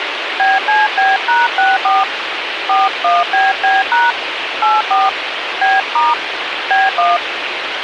DTMF, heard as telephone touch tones, dialled by hand, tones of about 190 ms, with radio hiss. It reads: BCB#64 41BB# 84 B* B1